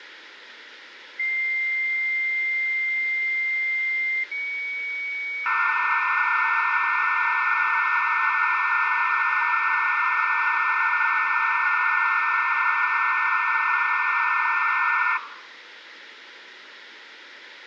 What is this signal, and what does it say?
Dial-up modem handshake (low-speed, two carriers), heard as two whistles, then hiss, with phone line noise.